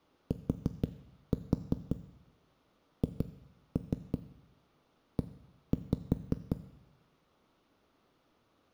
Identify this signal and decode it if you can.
Tap code, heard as knocks on a wall, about 5 knocks a second, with room echo. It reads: THE